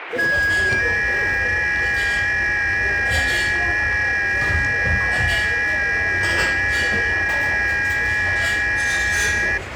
FT8 (several signals at once), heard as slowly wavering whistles, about 6.25 baud, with radio static and the noise of a restaurant.